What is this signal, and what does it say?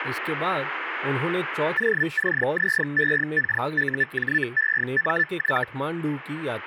Hellschreiber (Feld-Hell, 122.5 baud), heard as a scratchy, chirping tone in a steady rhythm, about 1750 Hz, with radio static and speech in Hindi. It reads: OCZEKUJEMY